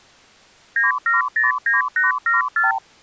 Multi-frequency trunk signalling (R2, with the far end's replies), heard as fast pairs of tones, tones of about 150 ms. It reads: 9709874